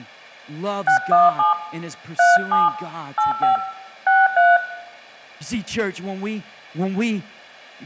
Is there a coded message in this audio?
Yes: DTMF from 0.9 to 4.6 s, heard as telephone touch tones, dialled by hand, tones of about 140 ms, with room echo and speech in English. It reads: 617 37 85 63